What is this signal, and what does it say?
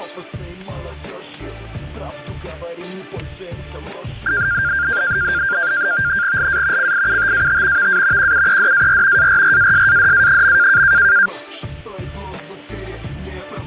NAVTEX (SITOR-B), 100 baud, 170 Hz shift, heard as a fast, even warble, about 1500 Hz centre, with fading and static crashes. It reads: LA CIUTAT VA QUEDAR ARRASADA.